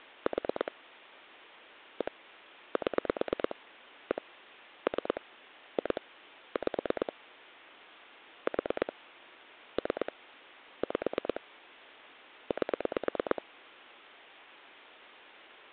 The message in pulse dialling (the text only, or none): 4 1 7 1 3 2 5 4 3 5 8